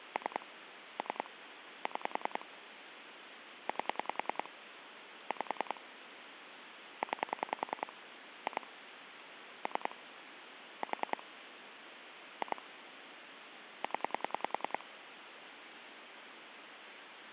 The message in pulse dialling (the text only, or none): 3 3 6 8 5 9 2 3 4 2 0